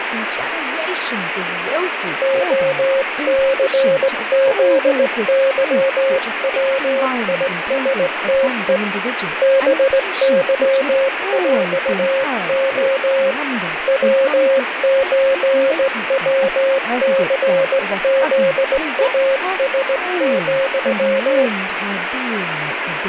Morse code (with Polish letters), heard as a keyed tone, hand-sent with a straight key, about 18 wpm, 540 Hz, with radio static and speech in English. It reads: OCZYWISTE BYŁO WÓWCZAS,